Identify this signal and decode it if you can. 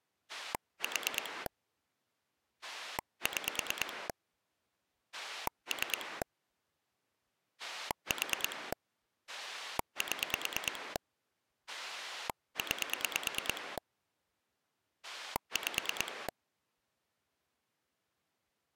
Pulse dialling, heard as a rotary dial, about 9 pulses a second. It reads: 4 6 3 4 7 9 5